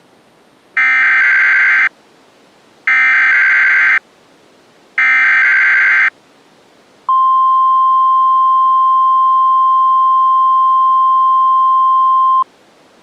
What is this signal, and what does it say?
Emergency Alert System (SAME) tones (header bursts, then the 1050 Hz attention tone), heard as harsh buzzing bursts, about 520.83 baud.